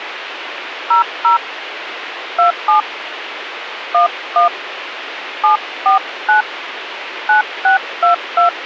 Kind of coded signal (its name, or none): DTMF